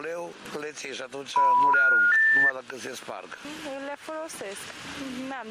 Telephone call progress tone (North American plan), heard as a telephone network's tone, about 980, 1430, 1800 Hz. Special information tone.